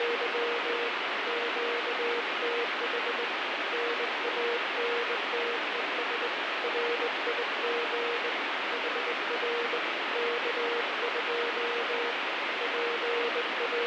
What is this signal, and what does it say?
Morse code, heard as a keyed tone, hand-sent with a straight key, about 20 wpm, 470 Hz, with heavy radio static. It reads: … QTH NANTES RIG HR K2 …